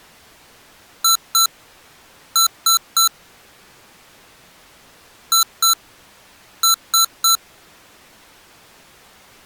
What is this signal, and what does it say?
Beep code, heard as beeps from a small speaker, played twice, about 1340 Hz. 2-3.